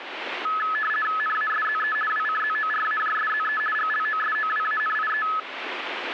RTTY (50 baud, 450 Hz shift), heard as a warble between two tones, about 1500 Hz centre, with radio static. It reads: NASZE WCZORAJSZE GLOSOWANIE